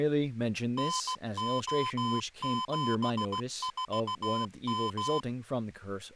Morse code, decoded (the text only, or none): NO74M